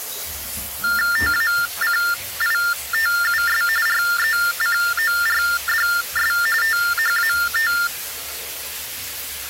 TTY/TDD text telephone tones (45.45 baud Baudot), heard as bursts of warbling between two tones, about 400 Hz shift, 1600 Hz centre, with the noise of a restroom. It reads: TACITUS RECORDS THAT